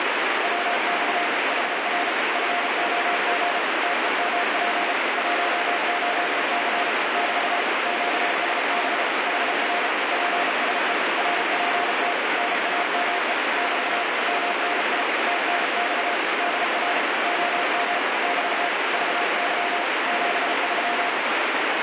Morse code, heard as a keyed tone, machine-sent, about 34 wpm, 700 Hz, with heavy radio static. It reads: WX HR FOG TEMP 18C <BT> QSB HR PSE RPT NAME <BT> MNI TNX DR OM <BT> VY 73